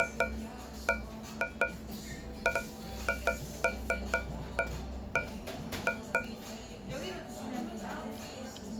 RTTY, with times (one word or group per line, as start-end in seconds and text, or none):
none